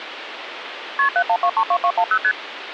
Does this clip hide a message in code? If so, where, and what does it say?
Yes: multi-frequency trunk signalling (R1, as on North American trunks) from 1.0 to 2.3 s, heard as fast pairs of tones, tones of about 70 ms, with phone line noise. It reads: KP 71232210 ST